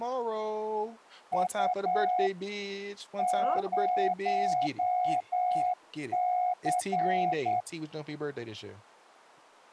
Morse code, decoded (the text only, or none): U 0C